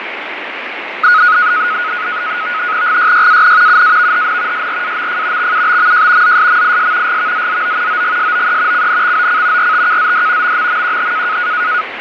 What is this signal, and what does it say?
NAVTEX (SITOR-B), 100 baud, 170 Hz shift, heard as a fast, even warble, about 1360 Hz centre, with radio static and fading. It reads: GYYAN UAVHN SRAMF XUBMJ ZSMIS GVZZO OGSOE CNXOC RTKZD MMMQH